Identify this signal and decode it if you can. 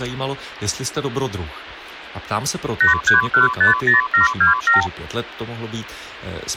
Multi-frequency trunk signalling (R2, with the far end's replies), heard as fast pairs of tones, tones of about 130 ms, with speech in Czech. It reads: 83150727